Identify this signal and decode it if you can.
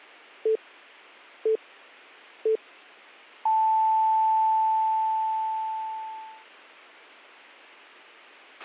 Radio time signal (three low pips and a long one an octave up, as on NHK), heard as pips, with a squelch burst at the end.